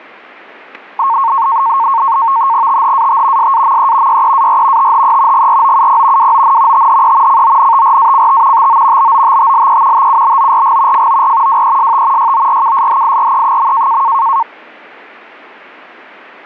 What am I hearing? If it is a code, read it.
NAVTEX (SITOR-B), 100 baud, 170 Hz shift, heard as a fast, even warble, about 1000 Hz centre, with static crashes. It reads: THAT SAME YEAR THE GROUP WON THE CONTRACT TO BOTTLE TUBORG FOR WEST YORKSHIRE.